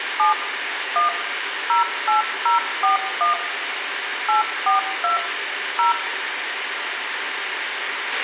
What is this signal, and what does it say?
DTMF, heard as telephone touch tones, dialled by machine, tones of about 130 ms, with radio hiss, a squelch burst at the end and room echo. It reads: 7 1 08041 842 0